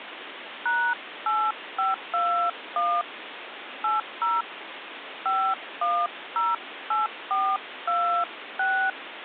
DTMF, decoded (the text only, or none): #8521 80 5108426